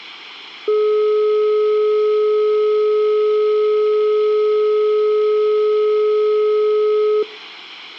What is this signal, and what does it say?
Telephone call progress tone (425 Hz plan, as in most of Europe), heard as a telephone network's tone, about 420 Hz. Dial tone.